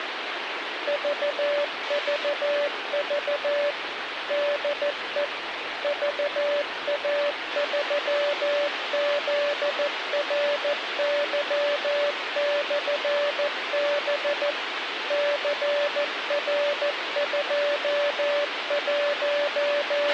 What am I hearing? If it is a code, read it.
Morse code, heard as a keyed tone, machine-sent, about 14 wpm, 580 Hz, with radio hiss and a squelch burst at the end. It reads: VVV DE VA3ZRY/B …